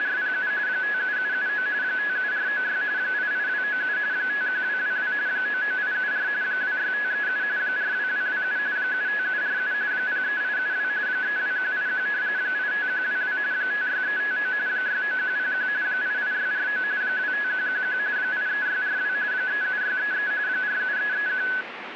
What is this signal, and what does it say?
RTTY (45.45 baud, 170 Hz shift), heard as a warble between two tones, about 1600 Hz centre, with radio static. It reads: … 57779 57496 88297 51222 99874 26537 42227 75747 03872 32181 85122 56359 69101 88649 25111 83642 37633 47331